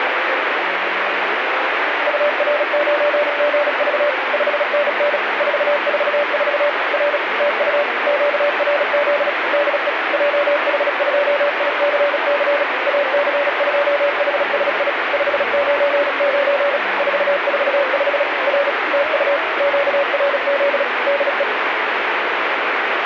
Morse code, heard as a keyed tone, machine-sent, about 36 wpm, 580 Hz, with radio static. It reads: UR9GV 5NN 444 R TU QRZ DE JH2ICC AC2HSI 599 445 R TU QRZ DE